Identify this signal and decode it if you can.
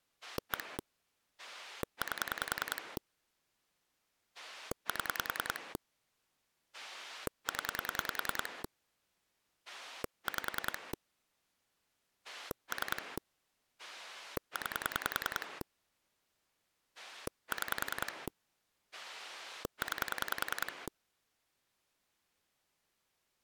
Pulse dialling, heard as a rotary dial, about 10 pulses a second. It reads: 1 8 7 0 5 3 9 6 9